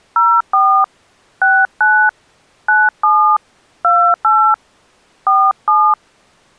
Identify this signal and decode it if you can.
DTMF, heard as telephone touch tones, dialled by hand, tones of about 280 ms. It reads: 04 69 97 28 47